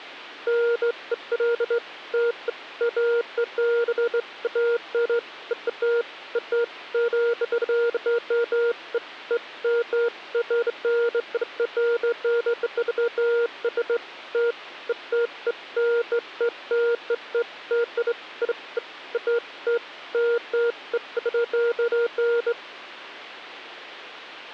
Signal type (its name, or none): none